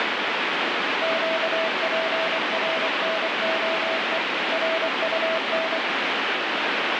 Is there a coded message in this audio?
Yes: Morse code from 1.0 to 5.8 s, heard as a keyed tone, machine-sent, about 24 wpm, 650 Hz, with heavy radio static. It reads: QPRNOE RUN